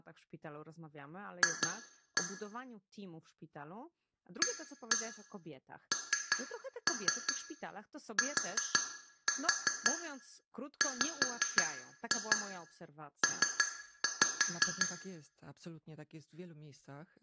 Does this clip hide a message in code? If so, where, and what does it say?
Yes: tap code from 1.4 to 14.9 s, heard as taps on glass, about 5 knocks a second, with room echo and speech in Polish. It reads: F ANTWP